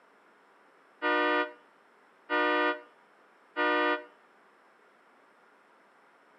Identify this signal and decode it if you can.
Train horn signal, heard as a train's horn, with room echo. 3 short. On North American railways: when stopped, the train will back up.